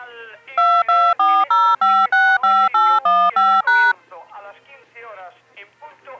DTMF, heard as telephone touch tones, dialled by machine, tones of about 250 ms. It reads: 2240565815#